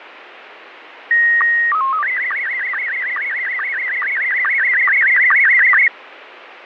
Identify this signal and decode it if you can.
SSTV (slow-scan television), Scottie S1, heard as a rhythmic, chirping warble, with radio static and fading.